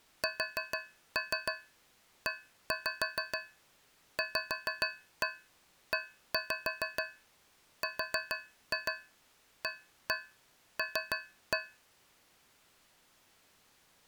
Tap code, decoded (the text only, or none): SEVERAL